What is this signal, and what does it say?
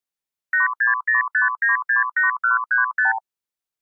Multi-frequency trunk signalling (R2, with the far end's replies), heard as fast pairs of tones, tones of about 140 ms. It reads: 8605968135